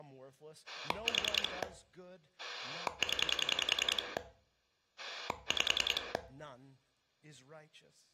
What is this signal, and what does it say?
Pulse dialling, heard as a rotary dial, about 10 pulses a second, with room echo and speech in English. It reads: 4 0 5